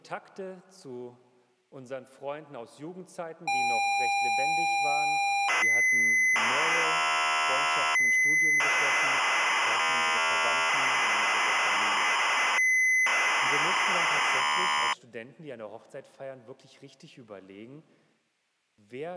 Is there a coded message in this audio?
Yes: ZX Spectrum tape loading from 3.5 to 14.9 s, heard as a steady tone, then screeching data.